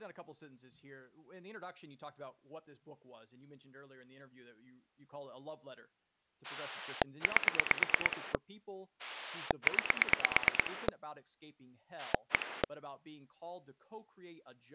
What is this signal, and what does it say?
Pulse dialling, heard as a rotary dial, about 9 pulses a second, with speech in English. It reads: 8 9 1